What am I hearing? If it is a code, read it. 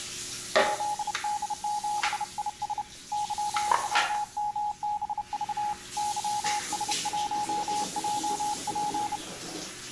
Morse code, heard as a keyed tone, hand-sent with a bug key, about 30 wpm, 840 Hz, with the noise of a restroom. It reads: ZD7IS YWMBV YS1JP